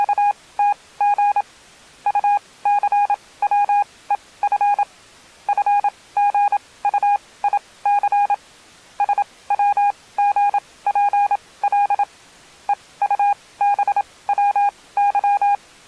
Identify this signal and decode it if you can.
Morse code, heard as a keyed tone, machine-sent, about 27 wpm, spaced as for 19 wpm, 820 Hz. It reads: … UCWEF FGUIC SWGPL EUBWY